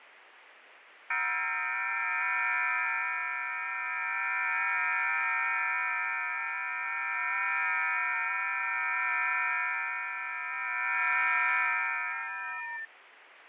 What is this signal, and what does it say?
FT8 (several signals at once), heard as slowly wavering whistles, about 6.25 baud, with radio static and fading.